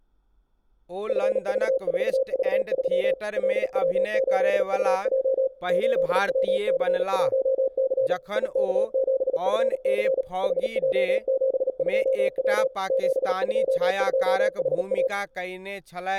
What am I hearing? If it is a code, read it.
Morse code, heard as a keyed tone, machine-sent, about 37 wpm, 530 Hz, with room echo and speech in Maithili. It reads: FV4V3 LW8UJ 8WC1C IK7FC HJ72W 722HA